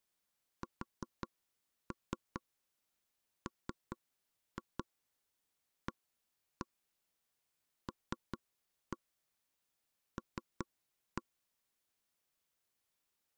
Tap code, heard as knocks on wood, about 5 knocks a second. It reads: SMALL